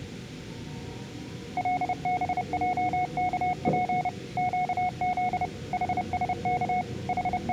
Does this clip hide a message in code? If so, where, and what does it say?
Yes: Morse code (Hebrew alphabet) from 1.5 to 7.5 s, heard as a keyed tone, machine-sent, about 30 wpm, 730 Hz, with the noise inside a subway train. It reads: לבעכף קז חשך …